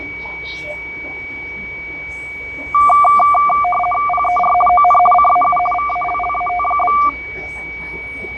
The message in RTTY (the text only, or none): PER ON CAU VALLAT?